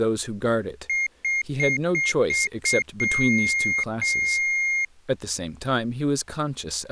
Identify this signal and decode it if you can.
Beep code, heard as a piezo beeper, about 2150 Hz, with speech in English. 6 short, 2 long.